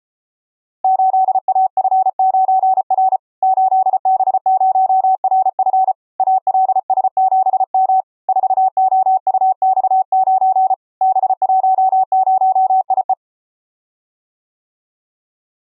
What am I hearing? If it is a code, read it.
Morse code, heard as a keyed tone, hand-sent with a paddle, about 34 wpm, 760 Hz. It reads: 8AF9R 8B0RF ALS7M 4OUX9 B10IE